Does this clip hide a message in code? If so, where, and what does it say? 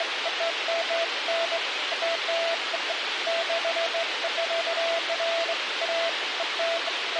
No, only beeps of irregular length, with radio hiss.